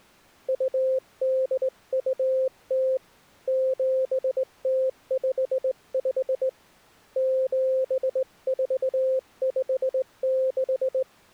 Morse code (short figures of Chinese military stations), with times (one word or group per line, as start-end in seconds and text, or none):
0.5-3.0 2820
3.5-6.5 7055
7.2-11.0 7456